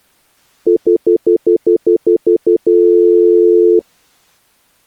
Telephone call progress tone (North American plan), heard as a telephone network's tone, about 350, 440 Hz, 0.1 s on and 0.1 s off. Stutter dial tone.